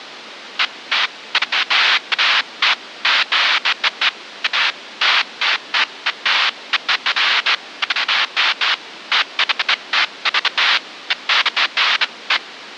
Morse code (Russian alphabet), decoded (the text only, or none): none